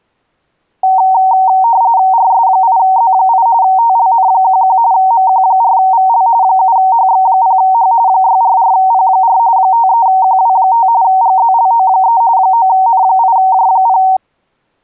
RTTY (45.45 baud, 170 Hz shift), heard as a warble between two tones, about 840 Hz centre. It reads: RS8Z8 TLN11 MQ4VL 7HX0H 644P4 53QW5 GZLO3 9N8J0